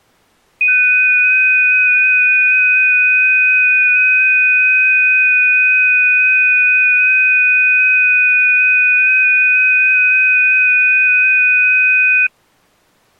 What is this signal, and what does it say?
FT8 (several signals at once), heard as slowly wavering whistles, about 6.25 baud.